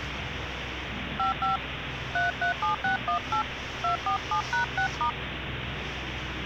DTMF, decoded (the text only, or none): 55 337618 247#6*